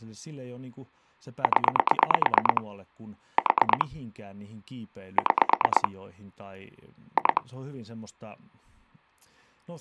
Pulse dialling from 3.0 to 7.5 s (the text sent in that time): 4 6 2